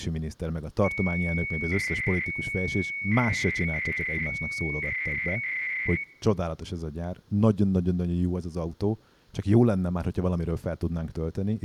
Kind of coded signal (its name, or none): 300-baud modem data